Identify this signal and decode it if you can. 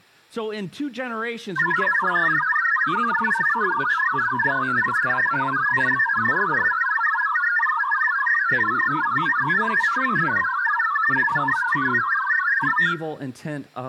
Multi-tone FSK (Olivia or MFSK type), about 1000 Hz wide, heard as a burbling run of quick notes, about 62.5 baud, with room echo and speech in English.